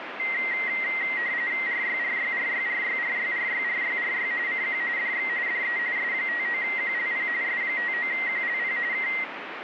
RTTY (45.45 baud, 170 Hz shift), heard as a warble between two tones, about 2000 Hz centre, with radio static. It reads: RYRYRYRYRYRYRYRY CQ DX DE S59QLP S59QLP K